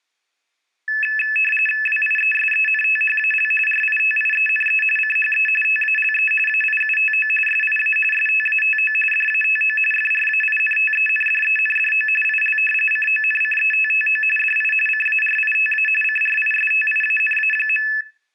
RTTY (45.45 baud, 850 Hz shift), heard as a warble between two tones, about 2150 Hz centre. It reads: WIESENTHAL RITIENE CHE TALE AIUTO SIA STATO DATO FRAINTENDENDO IL CONCETTO DI CARITA CRISTIANA.